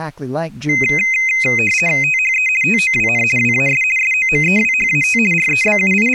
RTTY (50 baud, 450 Hz shift), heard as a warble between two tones, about 2300 Hz centre, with speech in English. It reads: THE TOWN WAS SOMEWHAT …